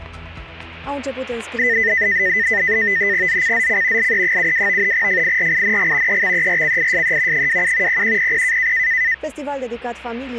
NAVTEX (SITOR-B), 100 baud, 170 Hz shift, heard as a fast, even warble, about 1900 Hz centre. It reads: ZCZC LE72 FIRING EXERCISE 27 0100